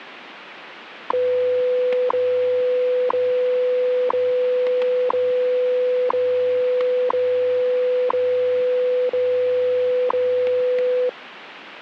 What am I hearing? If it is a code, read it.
Radio time signal (WWV, Colorado), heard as ticks, one a second, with radio static and static crashes.